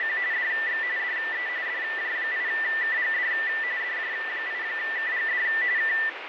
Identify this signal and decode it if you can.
RTTY (45.45 baud, 170 Hz shift), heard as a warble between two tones, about 1900 Hz centre, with radio static. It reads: … DX DE DJ8KGD DJ8KGD K